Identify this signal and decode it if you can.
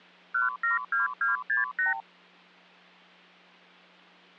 Multi-frequency trunk signalling (R2, with the far end's replies), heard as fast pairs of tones, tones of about 140 ms, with hum. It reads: 172268